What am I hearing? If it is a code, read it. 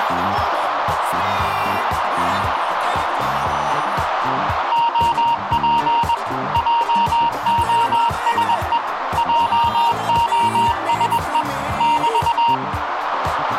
Morse code, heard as a keyed tone, machine-sent, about 21 wpm, 930 Hz, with radio static and a narrow filter. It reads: OP JOSE JOSE <BT>